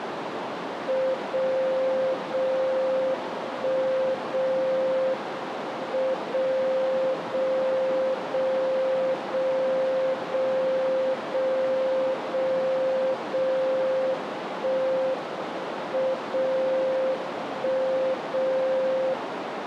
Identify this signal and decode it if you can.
Radio time signal (WWVB), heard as a tone whose level steps once a second, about 520 Hz, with radio static and a narrow filter. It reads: 0 0 1 0 M 0 0 0 0 0 0 0 0 1 M 0 1 0